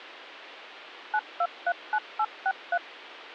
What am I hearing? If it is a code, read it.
DTMF, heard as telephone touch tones, dialled by machine, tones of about 60 ms. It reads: 9239863